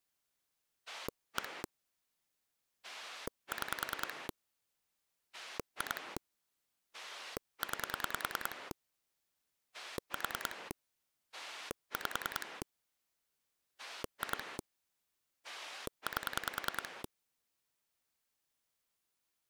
Pulse dialling, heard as a rotary dial, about 10 pulses a second. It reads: 1 6 2 9 4 5 2 8